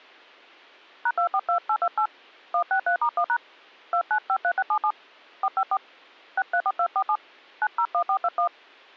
DTMF, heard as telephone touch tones, dialled by hand, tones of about 70 ms. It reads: #242828 163*1# 2953677 454 634247 901421